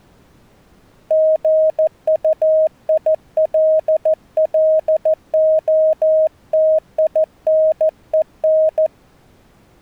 Morse code, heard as a keyed tone, hand-sent with a paddle, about 14 wpm, 630 Hz. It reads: GUILLOTINEN